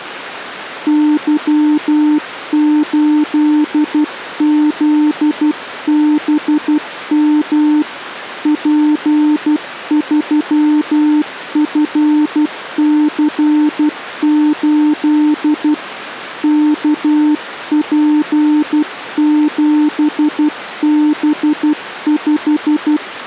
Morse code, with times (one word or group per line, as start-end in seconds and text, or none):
0.9-7.8 Y8ZBM
8.5-15.7 P3FC8
16.4-23.0 KP7B5